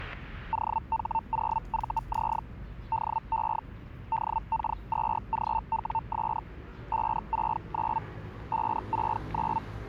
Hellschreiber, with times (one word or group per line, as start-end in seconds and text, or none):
0.5-2.4 OH0VZ
2.9-3.6 DE
4.1-6.4 DK2GWS
6.9-8.0 569
8.5-9.6 569